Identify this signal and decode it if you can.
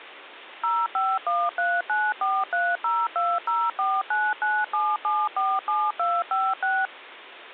DTMF, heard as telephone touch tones, dialled by machine, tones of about 230 ms. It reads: 05139430204997747256